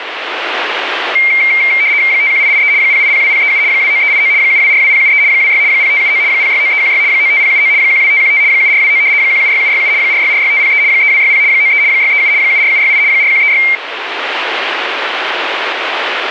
RTTY (75 baud, 170 Hz shift), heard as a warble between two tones, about 2200 Hz centre, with radio static. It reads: 51883 0802037 29389 7242073 26 0579 069316 95079 12515 7429 176767 4646503 3260 93 637 74768 4136